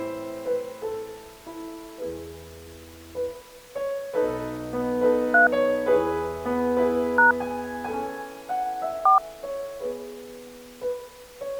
DTMF, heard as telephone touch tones, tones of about 130 ms. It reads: 3 # 4